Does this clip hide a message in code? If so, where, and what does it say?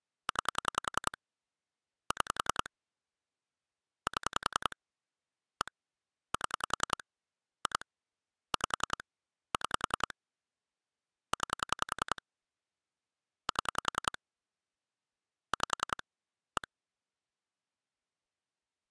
Yes: pulse dialling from 0.3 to 16.6 s, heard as clicks on a phone line, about 10 pulses a second. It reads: 9 6 7 1 7 2 5 6 9 7 5 1